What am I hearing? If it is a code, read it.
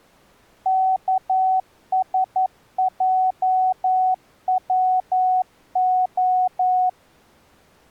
Morse code, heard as a keyed tone, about 11 wpm, 750 Hz. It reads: KSJWO